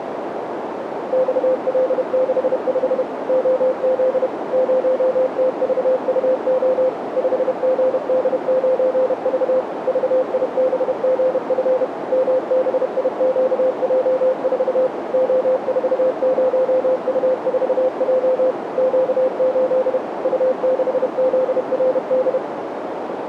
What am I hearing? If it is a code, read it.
Morse code, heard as a keyed tone, machine-sent, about 31 wpm, 520 Hz, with radio static and a narrow filter. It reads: XL65 OZ 0TVUO 5GD9V VIBGF MBIQJ4 O40U4J Q8 U6ZRD